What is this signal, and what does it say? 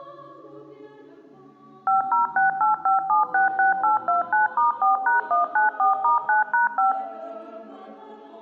DTMF, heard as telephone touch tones, dialled by machine, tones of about 140 ms, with room echo. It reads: 50685766829*4#194*9#5